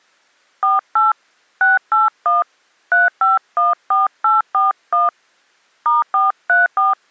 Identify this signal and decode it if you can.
DTMF, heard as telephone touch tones, dialled by hand, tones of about 160 ms. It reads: 48 681 3514841 *434